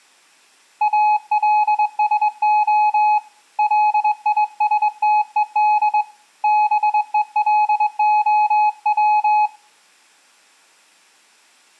Morse code, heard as a keyed tone, hand-sent with a straight key, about 22 wpm, 850 Hz. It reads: ALSO LISTED BELOW